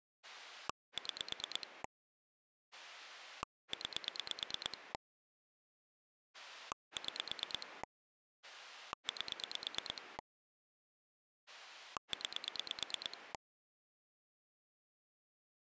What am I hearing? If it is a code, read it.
Pulse dialling, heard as a rotary dial, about 9 pulses a second. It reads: 6 9 6 8 9